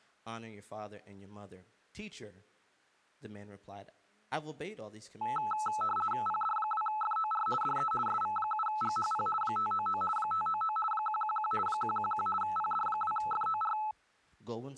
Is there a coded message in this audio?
Yes: RTTY (50 baud, 450 Hz shift) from 5.2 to 13.9 s, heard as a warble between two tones, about 1080 Hz centre, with speech in English. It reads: PD2FOR DE SV7GHP 599 599 111 111 PD2FOR